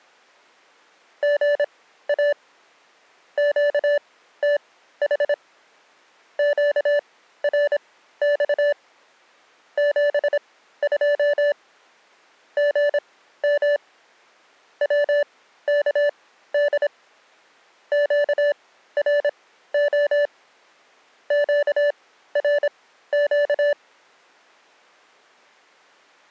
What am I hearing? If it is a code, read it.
Morse code, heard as electronic beeps, machine-sent, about 26 wpm, spaced as for 14 wpm, 580 Hz. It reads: GA QTH QRX 72 GM WKD QRO QRQ